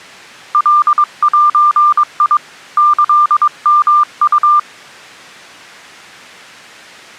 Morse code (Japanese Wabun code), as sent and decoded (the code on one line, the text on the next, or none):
.-.. .---. .. / -.-.. -- ..-
カゼ キヨウ